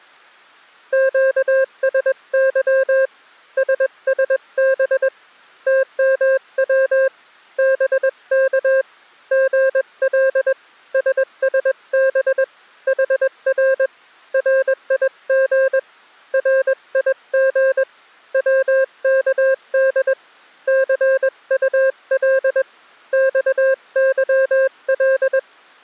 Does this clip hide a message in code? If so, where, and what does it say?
Yes: Morse code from 0.9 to 25.5 s, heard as a keyed tone, hand-sent with a paddle, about 21 wpm, 530 Hz. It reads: QSY SSB TMW BK GL SSB HR RIG RIG WKD CUL XYL